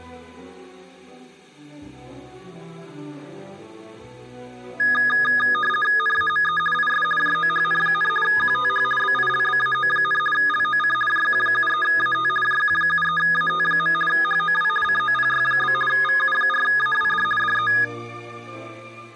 RTTY (50 baud, 450 Hz shift), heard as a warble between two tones, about 1450 Hz centre. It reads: NAME IS JOHN, QTH BILBAO, LOC JQ73AT JQ73AT. HOW COPY? VU4AWD DE